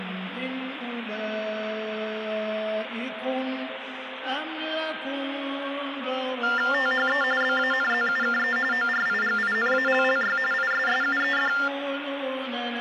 TTY/TDD text telephone tones (45.45 baud Baudot), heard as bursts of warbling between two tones, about 400 Hz shift, 1600 Hz centre, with phone line noise. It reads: THE BANZUKE ORIGINALLY ISSUED